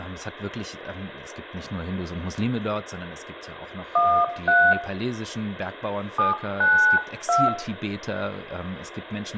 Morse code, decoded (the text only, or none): none